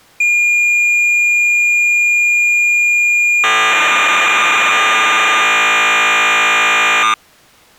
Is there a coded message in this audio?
Yes: cassette data (Kansas City type), 1200 baud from 0.2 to 7.1 s, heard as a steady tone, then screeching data.